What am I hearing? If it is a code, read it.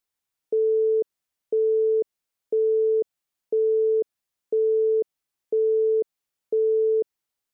Telephone call progress tone (single-tone plan, as in Europe, Japan and elsewhere), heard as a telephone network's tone, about 440 Hz, 0.5 s on and 0.5 s off. Busy tone.